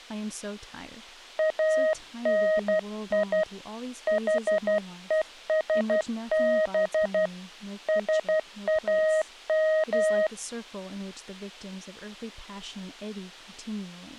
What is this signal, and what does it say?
Morse code (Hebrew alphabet), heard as a keyed tone, hand-sent with a paddle, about 12 wpm, 630 Hz, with speech in English. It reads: אני חושב שאם